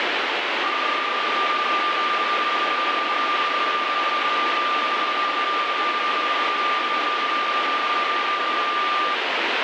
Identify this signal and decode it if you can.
PSK31 (31.25 baud), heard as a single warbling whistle, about 1190 Hz, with radio static.